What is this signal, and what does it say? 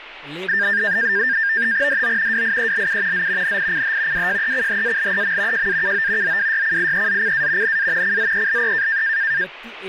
NAVTEX (SITOR-B), 100 baud, 170 Hz shift, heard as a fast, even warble, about 1700 Hz centre, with radio static and speech in Marathi. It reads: DO WIELU Z NICH WJECHALEM JAKO ZWYCIEZCA NA CZELE